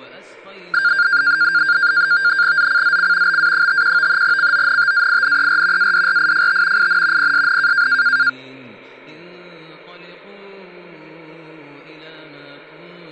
NAVTEX (SITOR-B), 100 baud, 170 Hz shift, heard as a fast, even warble, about 1500 Hz centre. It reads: ZCZC BA51 CONTAINER ADRIFT IN PSN